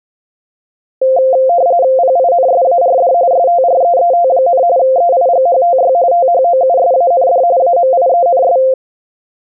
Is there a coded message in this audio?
Yes: RTTY (45.45 baud, 170 Hz shift) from 1.0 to 8.7 s, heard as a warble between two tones, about 610 Hz centre. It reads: PINSARD STREET, EIGHTY THOUSAND AMIENS